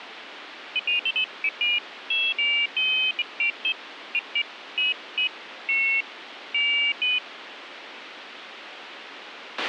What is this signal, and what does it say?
Pairs of high tones at irregular times, with radio hiss and a squelch burst at the end. There is no code.